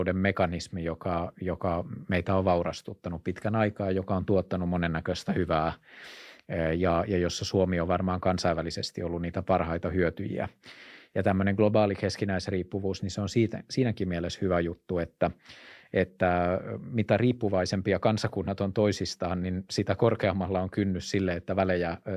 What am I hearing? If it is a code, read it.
Speech in Finnish. There is no code.